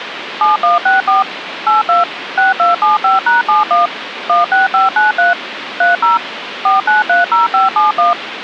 DTMF, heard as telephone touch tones, dialled by machine, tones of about 150 ms, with phone line noise. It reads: 7164 82 6275#71 16593 30 4930571